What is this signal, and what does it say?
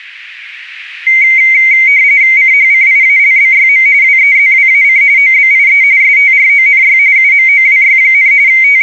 RTTY (45.45 baud, 170 Hz shift), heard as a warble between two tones, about 2150 Hz centre. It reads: CHCIALBYM WEZWAC OBIE STRONY UMOWY, …